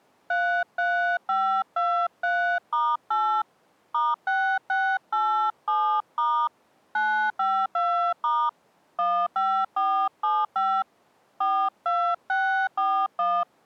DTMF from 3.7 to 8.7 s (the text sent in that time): *6687* 952*